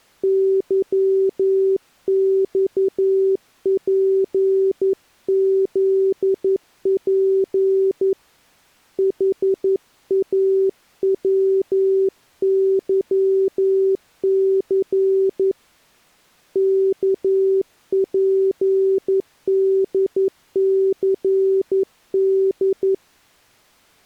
Morse code, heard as a keyed tone, hand-sent with a paddle, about 11 wpm, 380 Hz. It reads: YXPZP HAWYC KPDCD